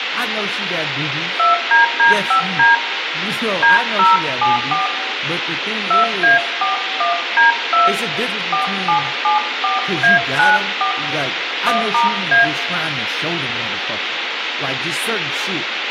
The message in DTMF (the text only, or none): 2DD5D D074 2A41D2 4774A94 1*A